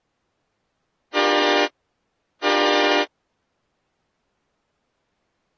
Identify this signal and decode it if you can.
Train horn signal, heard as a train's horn. 2 short. On North American railways: a signal is acknowledged.